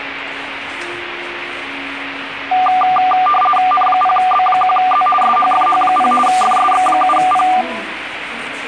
RTTY (50 baud, 450 Hz shift), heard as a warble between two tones, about 970 Hz centre, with radio static and the noise of a crowd indoors. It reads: N0B1Z SHFH0 FSX7P